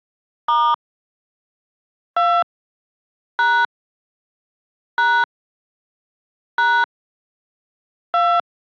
DTMF, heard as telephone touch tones, dialled by hand, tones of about 260 ms. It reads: * 2 # # # 2